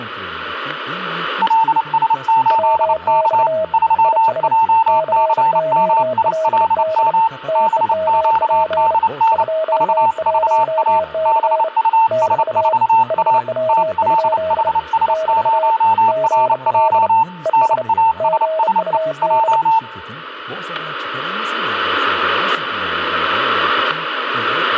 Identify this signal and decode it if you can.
Morse code, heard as two keyed tones, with static crashes and speech in Turkish. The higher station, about 29 wpm, 900 Hz: LS8K 3JCMILM BQDN VVA BUS4A TLHS0RJ NASSE J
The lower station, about 30 wpm, 640 Hz: WX IS COLD TEMP 21C <BT> HW? <BT> GL ES GUD